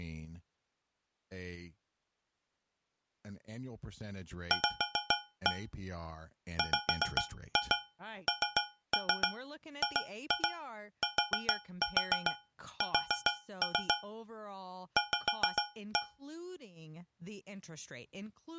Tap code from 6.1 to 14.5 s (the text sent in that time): WNGTS